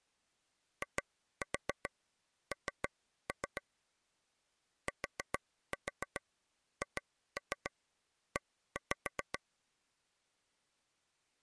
Tap code, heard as taps on a table, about 7 knocks a second. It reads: IN THE